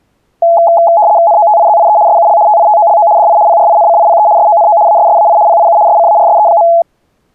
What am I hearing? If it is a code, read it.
RTTY (75 baud, 170 Hz shift), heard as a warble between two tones, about 760 Hz centre. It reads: NOTIZIE SUL TITOLO DI PRINCIPE SONO ASSAI PIU SCARSE.